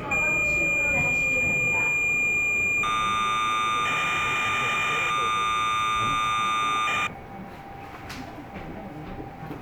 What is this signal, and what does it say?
Cassette data (Kansas City type), 1200 baud, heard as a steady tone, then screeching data, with the noise inside a subway train.